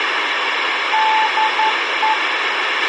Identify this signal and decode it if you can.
Morse code, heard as a keyed tone, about 11 wpm, 870 Hz, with radio hiss and a squelch burst at the end. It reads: DE